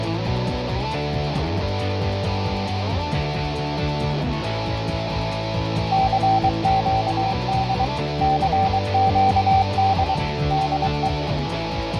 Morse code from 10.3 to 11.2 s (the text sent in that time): DE